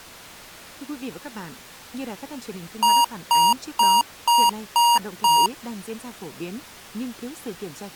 Beep code, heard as beeps from a small speaker, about 950 Hz, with speech in Vietnamese. 6 short. In AMI BIOS tables: keyboard controller gate A20 failure; in Dell tables: video card failure.